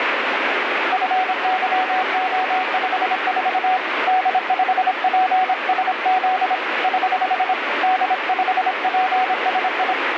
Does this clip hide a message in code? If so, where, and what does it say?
Yes: Morse code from 0.9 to 10.0 s, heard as a keyed tone, hand-sent with a paddle, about 26 wpm, 750 Hz, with radio static. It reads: FYO54 D5PSZ <HH> D5PSI